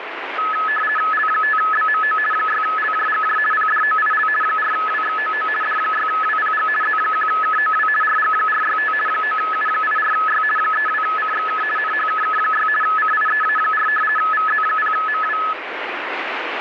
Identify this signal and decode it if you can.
RTTY (50 baud, 450 Hz shift), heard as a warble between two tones, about 1500 Hz centre, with radio static. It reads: L5BMO 6LJGJ PDOIL 4WXOO D6WPG Z1KOW RG465 9U84Y 32CXK NHKK6 CIEA4 VZ0MW